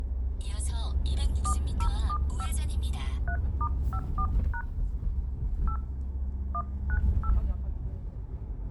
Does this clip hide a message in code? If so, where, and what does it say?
Yes: DTMF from 1.5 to 7.3 s, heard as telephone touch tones, dialled by hand, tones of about 70 ms, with the noise inside a car. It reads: 4075 3*54# 8 198